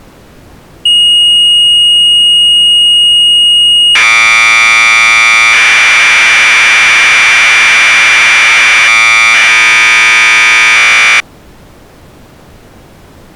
Commodore tape loading (standard loader), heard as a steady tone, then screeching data.